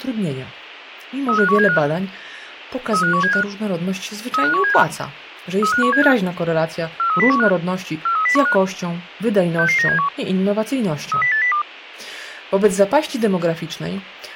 Five-tone selective call (CCIR), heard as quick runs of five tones, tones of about 100 ms, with speech in Polish. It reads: 35175 35175 35175 35175 43015 43015 66971 30802